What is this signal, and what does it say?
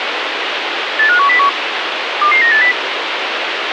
Five-tone selective call (CCIR), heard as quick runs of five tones, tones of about 100 ms, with radio hiss. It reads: 85101 22980